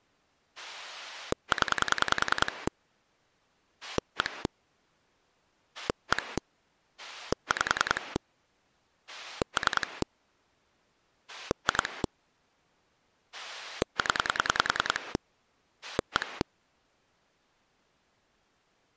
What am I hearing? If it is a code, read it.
Pulse dialling, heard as a rotary dial, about 10 pulses a second. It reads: 0 1 1 5 3 2 0 1